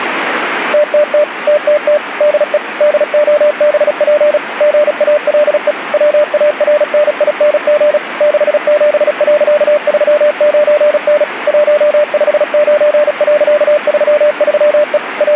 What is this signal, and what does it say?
Morse code, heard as a keyed tone, machine-sent, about 36 wpm, 600 Hz, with radio static. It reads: TTT TTT DE DOBP GALE WARNING 67.39N 159.33E …